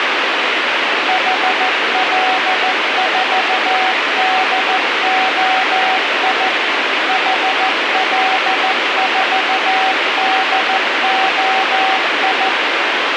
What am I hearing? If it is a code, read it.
Morse code, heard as a keyed tone, machine-sent, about 14 wpm, 760 Hz, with radio hiss. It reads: HL4DOI HL4DOI